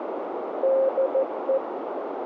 Morse code, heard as a keyed tone, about 14 wpm, 530 Hz, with radio static and a narrow filter. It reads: DE